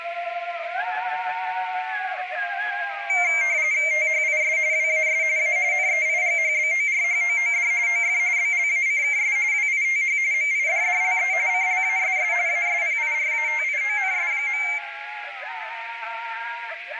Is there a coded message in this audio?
Yes: RTTY (45.45 baud, 170 Hz shift) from 3.1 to 14.8 s, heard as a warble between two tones, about 2200 Hz centre, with radio static and a narrow filter. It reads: THIS WAS A NEIGHBORHOOD OF BLACKS WITH MIDDLE CLASS ASPIRATIONS.